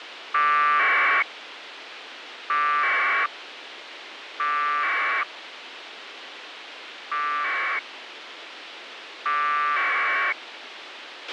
Packet radio (AX.25, as in APRS), 1200 baud, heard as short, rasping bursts, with radio hiss and a squelch burst at the end.